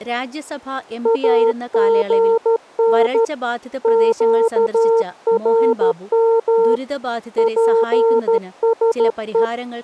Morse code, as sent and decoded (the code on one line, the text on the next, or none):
.- --. -. / --.- .-. -- / .--. ... .
AGN QRM PSE